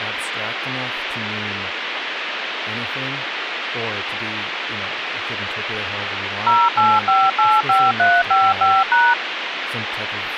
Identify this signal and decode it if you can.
DTMF, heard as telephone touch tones, dialled by machine, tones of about 220 ms, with phone line noise and speech in English. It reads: 08585355#